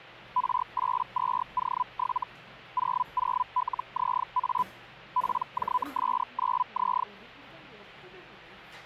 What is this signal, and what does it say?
Hellschreiber (Feld-Hell, 122.5 baud), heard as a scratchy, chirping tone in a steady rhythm, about 1000 Hz, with the noise of a crowd indoors. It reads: R82O7 00LZA PJS9Z